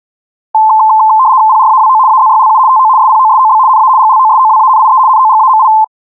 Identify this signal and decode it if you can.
RTTY (75 baud, 170 Hz shift), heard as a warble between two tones, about 960 Hz centre. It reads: PRAWO AZYLU TO SPOSOB NA GLOSOWANIE NOGAMI